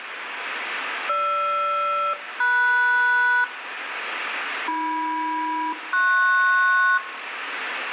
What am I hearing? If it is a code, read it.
Aircraft SELCAL, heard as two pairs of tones, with radio static and room echo. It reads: GR-MS AM-PS